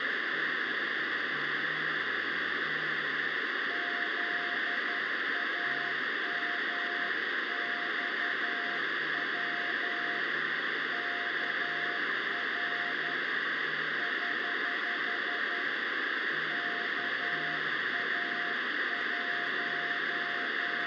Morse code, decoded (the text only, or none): ZAMXW KR <HH> …